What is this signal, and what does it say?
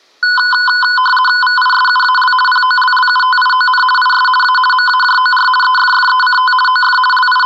RTTY (50 baud, 450 Hz shift), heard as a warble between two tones, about 1240 Hz centre. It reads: VISUAL POLLUTION IS A MAJOR EFFECT OF …